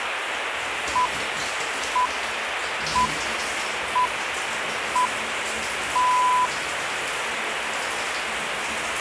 Radio time signal (six pips, as the Greenwich Time Signal), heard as pips, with radio static and the noise of a restroom.